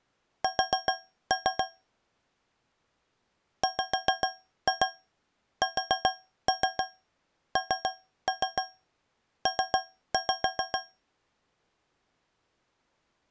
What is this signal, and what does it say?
Tap code, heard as taps on a metal pipe, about 7 knocks a second. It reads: S WSNP